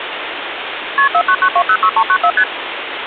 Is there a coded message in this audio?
Yes: multi-frequency trunk signalling (R1, as on North American trunks) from 1.0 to 2.4 s, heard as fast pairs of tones, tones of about 70 ms, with phone line noise. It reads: KP 499206394 ST